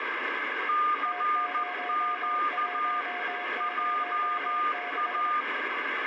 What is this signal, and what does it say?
Morse code, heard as two keyed tones, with heavy radio static. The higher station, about 14 wpm, 1210 Hz: CQ JA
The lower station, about 24 wpm, 720 Hz: T0106